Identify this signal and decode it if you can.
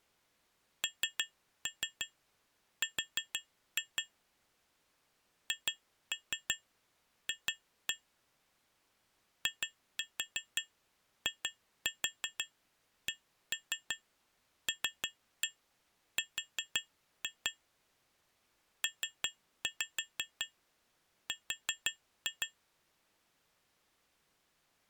Tap code, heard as taps on glass, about 5 knocks a second. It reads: NR HF IICLR PR